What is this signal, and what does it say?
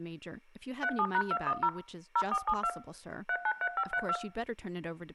DTMF, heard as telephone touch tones, dialled by machine, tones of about 60 ms, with room echo and speech in English. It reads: 37#210 0472 393532